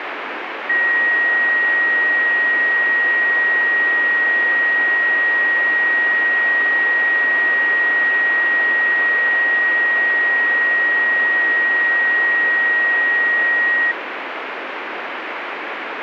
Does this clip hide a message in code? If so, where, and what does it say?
No, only a steady tone, with radio static.